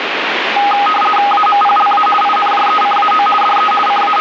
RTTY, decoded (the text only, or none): AMPLA INJECAO DE …